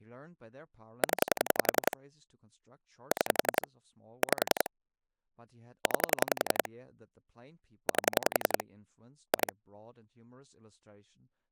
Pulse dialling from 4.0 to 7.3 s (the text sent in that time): 5 9